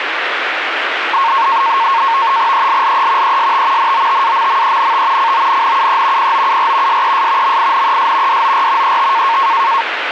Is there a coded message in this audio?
Yes: NAVTEX (SITOR-B), 100 baud, 170 Hz shift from 1.1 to 9.8 s, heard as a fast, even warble, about 1000 Hz centre, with radio static. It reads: ELLE EST NOTAMMENT CONNUE POUR SES MINES DOR ET